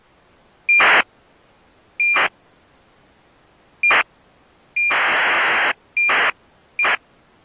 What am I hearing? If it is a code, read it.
ACARS aircraft data, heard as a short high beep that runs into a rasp, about 2400 baud.